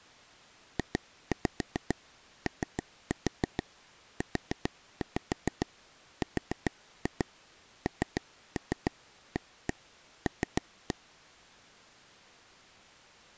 Tap code, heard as taps on a table, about 7 knocks a second. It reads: JOURNAL